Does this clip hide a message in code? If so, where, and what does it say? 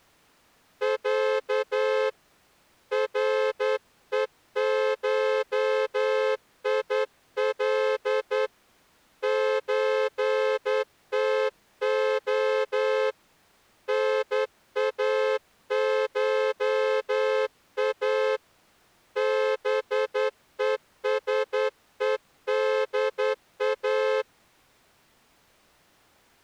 Yes: Morse code (Russian alphabet) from 0.8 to 24.3 s, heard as a horn, hand-sent with a straight key, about 10 wpm. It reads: Я РЕШИЛ ЧТО НАША БЕСЕДА